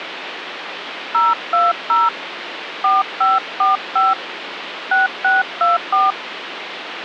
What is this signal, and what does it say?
DTMF, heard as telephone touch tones, dialled by hand, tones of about 170 ms, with phone line noise. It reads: 020 4545 6624